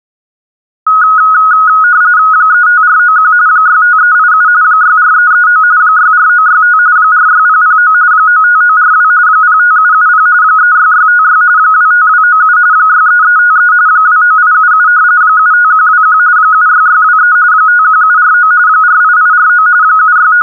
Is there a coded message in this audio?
Yes: RTTY (45.45 baud, 170 Hz shift) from 0.9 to 20.4 s, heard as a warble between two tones, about 1360 Hz centre. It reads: 35491 65387 64339 64965 46009 95942 05770 36656 25297 63353 29877 75121 76623 51749 48849 …